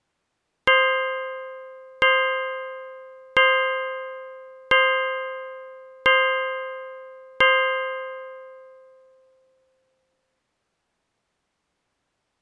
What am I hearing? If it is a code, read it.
Clock strike, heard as a bell. 6. Six o'clock.